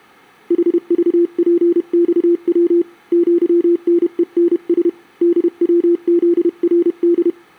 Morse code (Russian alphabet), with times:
0.5-2.8 ХЖПЬВ
3.1-4.9 ЪНЕНС
5.2-7.3 ДВЗРД

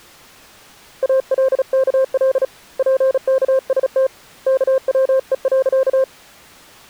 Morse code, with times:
1.0-2.4 ALKL
2.8-4.1 PKST
4.5-6.0 KWE.

